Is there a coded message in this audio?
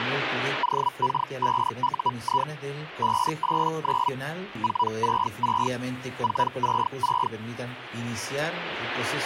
Yes: Hellschreiber (Feld-Hell, 122.5 baud) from 0.6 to 7.3 s, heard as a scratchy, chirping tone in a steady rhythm, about 980 Hz. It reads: OK5UI 589 466 466